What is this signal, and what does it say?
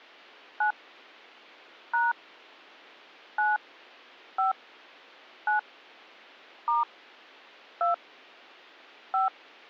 DTMF, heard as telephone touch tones, dialled by hand, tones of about 140 ms. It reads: 9 # 9 5 9 * 2 5